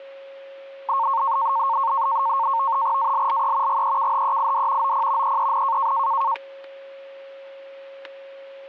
NAVTEX (SITOR-B), 100 baud, 170 Hz shift, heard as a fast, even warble, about 1000 Hz centre, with static crashes and a steady whistle near 550 Hz. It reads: ALLE GEKHEID OP EEN